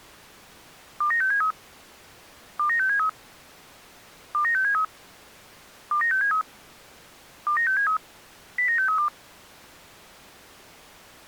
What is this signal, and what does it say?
Five-tone selective call (CCIR), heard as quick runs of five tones, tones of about 100 ms. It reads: 29673 29673 29673 29673 29673 09632